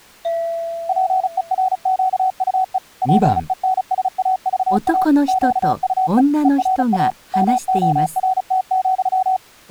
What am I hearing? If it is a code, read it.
Morse code, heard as a keyed tone, machine-sent, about 35 wpm, 750 Hz, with speech in Japanese. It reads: PERQUE PENSAVA QUE ERA MORT,